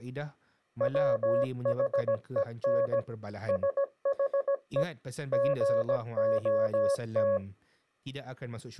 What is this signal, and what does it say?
Morse code, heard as a keyed tone, machine-sent, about 17 wpm, 560 Hz, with speech in Malay. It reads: WHEN SHE GOT